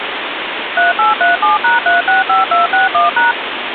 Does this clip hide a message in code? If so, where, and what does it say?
Yes: DTMF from 0.8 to 3.3 s, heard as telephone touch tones, dialled by machine, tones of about 150 ms, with phone line noise. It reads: 3837#365261#